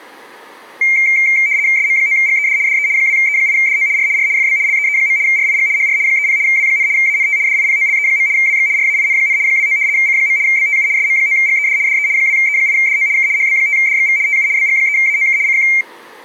RTTY (75 baud, 170 Hz shift), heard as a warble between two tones, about 2200 Hz centre. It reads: SM9GED DE 2E8DO R R FB LEE. RIG HR 30 W, ANT DIPOLE. WX RAIN, 29 C. BTU SM9GED DE 2E8DO K HB5DXV TU BG3AOK CQ